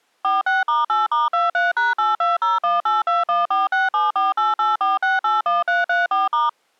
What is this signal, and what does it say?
DTMF, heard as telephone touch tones, dialled by machine, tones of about 170 ms. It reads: 46*8*23#82018214674884681334*